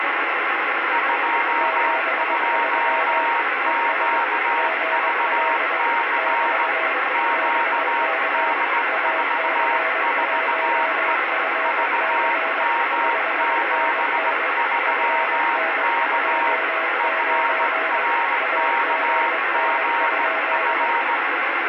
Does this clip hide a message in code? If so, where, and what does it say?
Yes: Morse code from 0.9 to 21.2 s, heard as two keyed tones, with heavy radio static. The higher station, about 17 wpm, 930 Hz: 22QVC QD44E VM73K FRKGF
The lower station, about 21 wpm, 650 Hz: 73 ES GL <BT> BK AC1FC 5NN FN29 AGN?